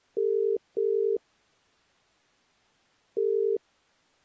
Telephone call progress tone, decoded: ringback tone

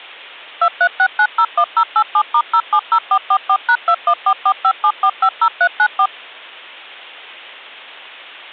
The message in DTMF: 236901087*070444#214457450394

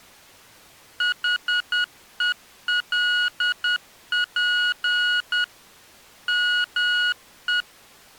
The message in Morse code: HELP ME

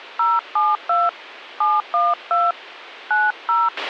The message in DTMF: 072 712 90

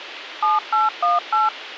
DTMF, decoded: 7818

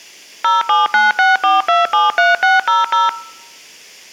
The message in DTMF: 07964273600

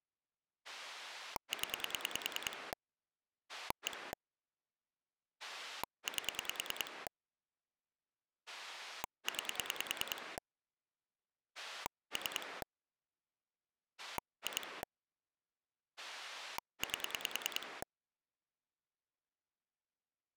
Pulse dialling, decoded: 0 1 8 9 3 2 8

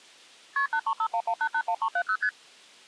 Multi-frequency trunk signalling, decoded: KP 83511881370 ST

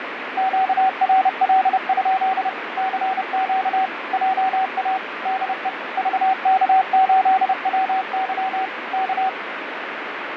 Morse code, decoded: QRL? CQ JA DE VK8WY K

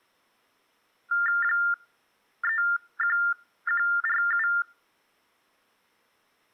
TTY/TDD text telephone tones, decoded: 31147

